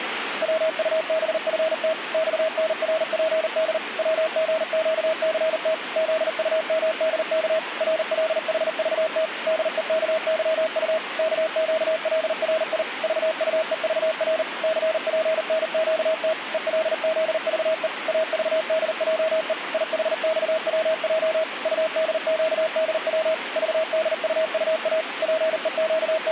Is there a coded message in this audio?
Yes: Morse code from 0.4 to 26.3 s, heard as a keyed tone, machine-sent, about 39 wpm, 640 Hz, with radio static. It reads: WUBFT XNRPD WGQCT ZUMDK RLHVT DEKYU KQLRI VUEVR CPNQT ELZVE AVDJE IHXWJ UDQDW VDUUA …